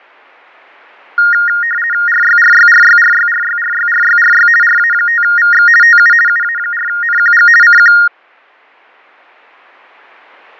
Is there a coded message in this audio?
Yes: RTTY (50 baud, 450 Hz shift) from 1.2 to 8.1 s, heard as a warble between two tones, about 1650 Hz centre. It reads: RYRYRYRYRYRYRYRY RA5VX TU UA4NQG CQ